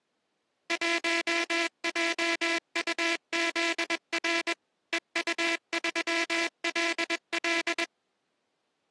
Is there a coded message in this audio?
Yes: Morse code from 0.6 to 7.9 s, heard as a buzzer, machine-sent, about 21 wpm. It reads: 1JUZR EU3LL